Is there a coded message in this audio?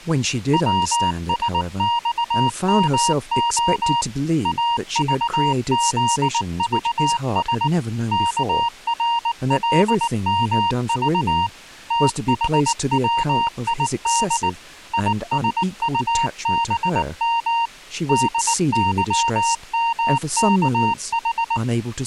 Yes: Morse code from 0.5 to 21.6 s, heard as a keyed tone, machine-sent, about 19 wpm, 930 Hz, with speech in English. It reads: WSXMO AVZVS KRLMV THWID ISUBM DYMKH